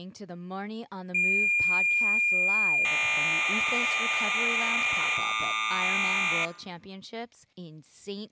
Cassette data (Kansas City type), 1200 baud, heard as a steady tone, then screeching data, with speech in English.